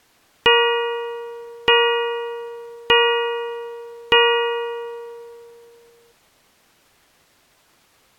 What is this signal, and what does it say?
Clock strike, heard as a bell. 4. Four o'clock.